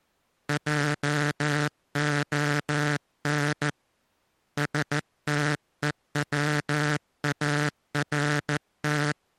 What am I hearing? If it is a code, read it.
Morse code, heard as a buzzer, hand-sent with a paddle, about 14 wpm. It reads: JON STEWART